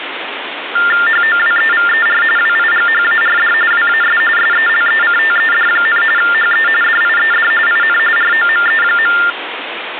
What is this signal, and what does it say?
TTY/TDD text telephone tones (45.45 baud Baudot), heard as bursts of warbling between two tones, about 400 Hz shift, 1600 Hz centre, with phone line noise. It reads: HOWEVER WIGHARD WAS SELECTED, HE DIED IN ROME.